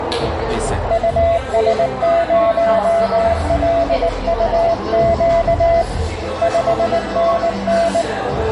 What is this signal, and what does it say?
Morse code, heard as a keyed tone, hand-sent with a paddle, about 19 wpm, 670 Hz, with radio static, a narrow filter and the noise of a cafe. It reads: US0LUQ 5NN